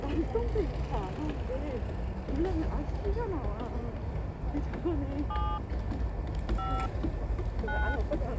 DTMF, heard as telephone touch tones, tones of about 280 ms, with the noise of a park. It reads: 7 5 9